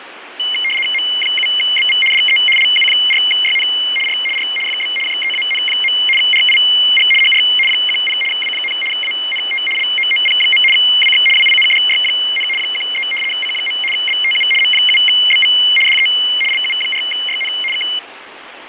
RTTY (75 baud, 850 Hz shift), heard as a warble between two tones, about 2550 Hz centre, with radio static. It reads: M7BV DE LU4YN R R FB JEAN. RIG HR 10 W, ANT LOOP. WX WINDY, 13 C. BTU M7BV DE LU4YN K